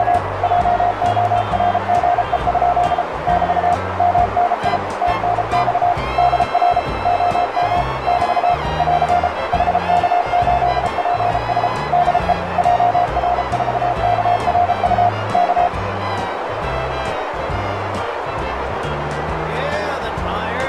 Morse code, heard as a keyed tone, machine-sent, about 33 wpm, 710 Hz, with radio static and a narrow filter. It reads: … JORGE? <BT> MNI TNX DR OM <BT> <AR> HK8PS DE JR4KRU K